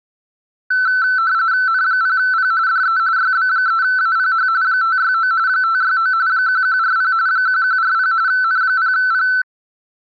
RTTY (45.45 baud, 170 Hz shift), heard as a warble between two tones, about 1420 Hz centre. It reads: N0P DE YB3APH 569 569 1140 1140 N0P